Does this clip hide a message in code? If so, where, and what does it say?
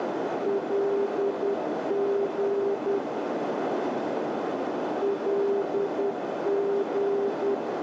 Yes: Morse code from 0.4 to 7.6 s, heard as a keyed tone, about 10 wpm, 400 Hz, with heavy radio static and a narrow filter. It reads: LG LG